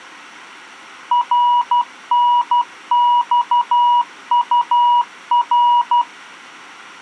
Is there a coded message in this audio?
Yes: Morse code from 1.1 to 6.1 s, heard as a keyed tone, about 12 wpm, 970 Hz. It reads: RNXUR